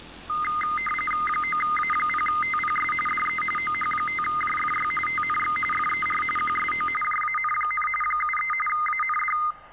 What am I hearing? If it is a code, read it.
RTTY (45.45 baud, 850 Hz shift), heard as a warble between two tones, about 1650 Hz centre, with static crashes and street noise. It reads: 9A0TPS DE OH5JFY TNX FER QSO JAN, 73 AND